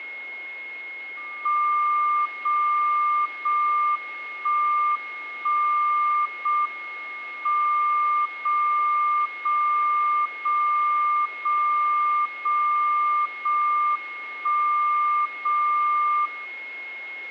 Radio time signal (JJY), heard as a tone whose level steps once a second, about 1190 Hz, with a steady whistle near 2160 Hz. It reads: 0 0 1 1 0 M 0 0 0 0 0 0 1 0 0